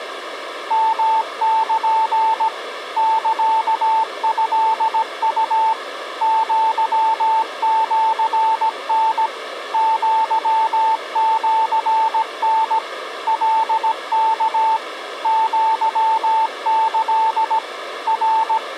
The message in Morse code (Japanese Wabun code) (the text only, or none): ヨル サトウ アシタ アシタ カワ アキ …